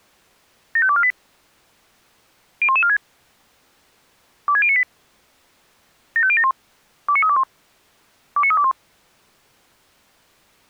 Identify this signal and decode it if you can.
Five-tone selective call (ZVEI), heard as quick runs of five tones, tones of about 70 ms. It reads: 75248 01146 26098 75071 29321 29321